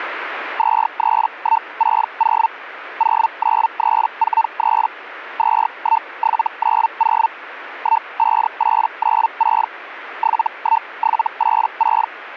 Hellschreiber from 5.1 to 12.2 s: 21790 15896 71786

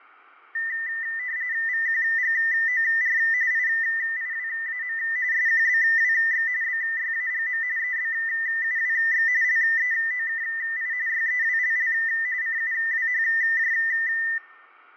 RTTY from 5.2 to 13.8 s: SQBWX BYAGM EBUWX LEOKI YEWLL CUWHJ

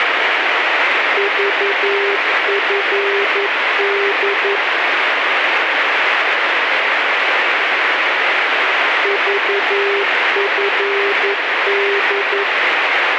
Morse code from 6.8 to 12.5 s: VFD

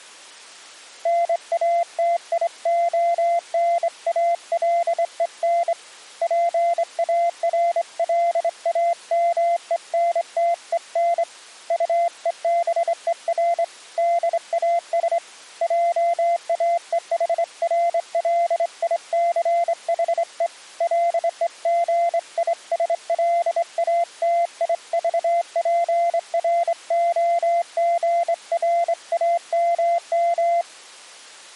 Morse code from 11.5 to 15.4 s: UEBER DAS

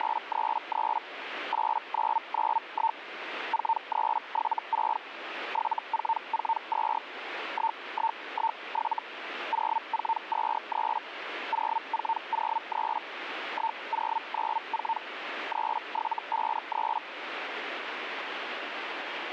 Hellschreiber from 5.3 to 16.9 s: 7442 1117 0423 0403 1094 3753

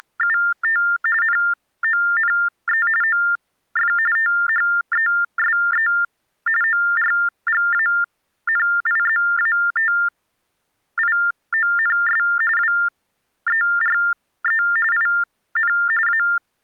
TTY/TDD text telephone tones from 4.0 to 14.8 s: THESE ORGANIZATIONS WERE

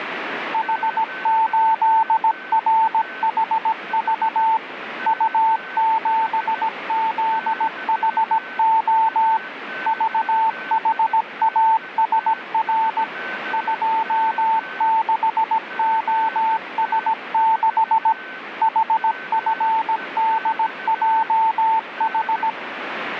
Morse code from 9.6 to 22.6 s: VHASR 26OS6 HFDJH

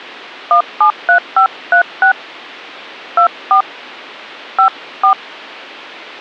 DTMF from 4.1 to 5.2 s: 54

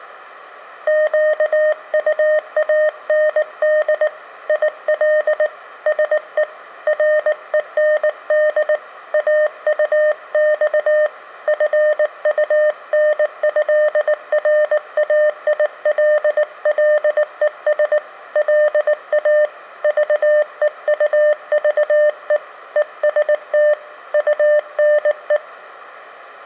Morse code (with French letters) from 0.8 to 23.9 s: QUAND IL SE REND AUX FUNÉRAILLES LA VEUVE EST

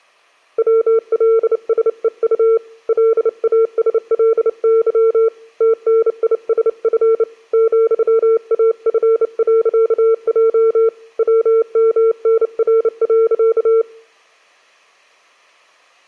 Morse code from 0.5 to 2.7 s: WLSEU

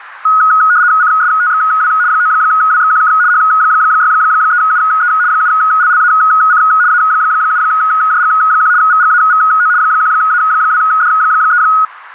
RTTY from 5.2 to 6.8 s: 7LLAC

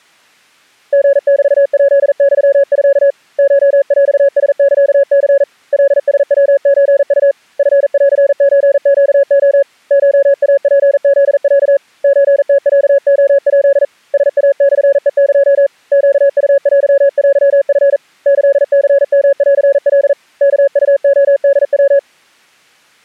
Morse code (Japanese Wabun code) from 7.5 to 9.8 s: チンソネレ

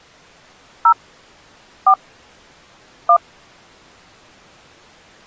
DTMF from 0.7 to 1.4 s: 0

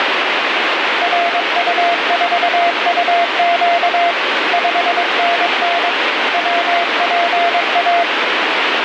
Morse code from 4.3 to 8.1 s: 5NN WPA

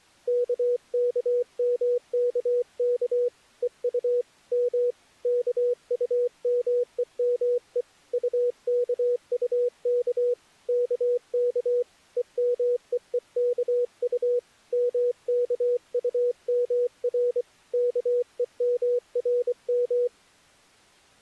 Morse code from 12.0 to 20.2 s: EMEEKU MKUMR KEMRM

